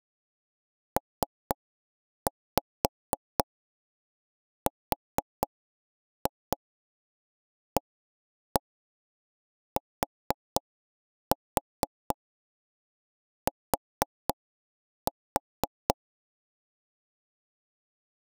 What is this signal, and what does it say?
Tap code, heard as knocks on wood, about 4 knocks a second. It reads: PRATT